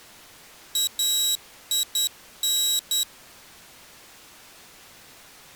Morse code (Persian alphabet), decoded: این

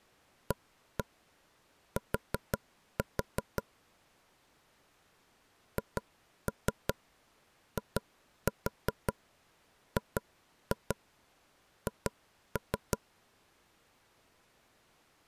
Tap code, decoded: AT HIGH

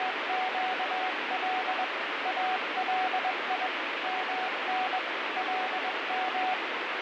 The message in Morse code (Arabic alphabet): … الي من لم

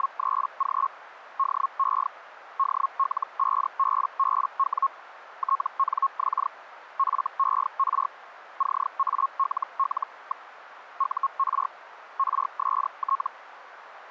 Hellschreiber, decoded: … DE DL5BBW TNX FER CALL. UR RST

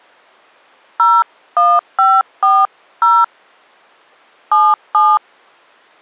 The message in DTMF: 01540 77

